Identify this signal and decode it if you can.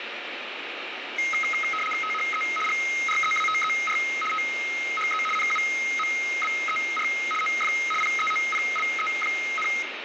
RTTY (75 baud, 850 Hz shift), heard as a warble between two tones, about 1700 Hz centre, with radio static and room echo. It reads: THE GREATER THE NUMBER OF PEOPLE,